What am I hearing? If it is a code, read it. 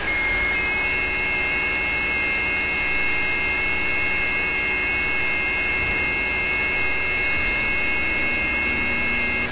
FT8 (several signals at once), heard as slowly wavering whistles, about 6.25 baud, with radio static, a steady whistle near 1640 Hz and street noise.